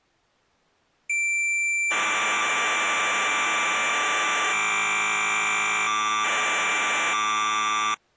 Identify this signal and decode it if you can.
Cassette data (Kansas City type), 1200 baud, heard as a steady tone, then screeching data.